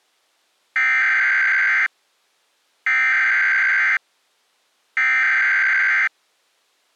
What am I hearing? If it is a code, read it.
Emergency Alert System (SAME) tones (header bursts), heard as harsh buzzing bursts, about 520.83 baud.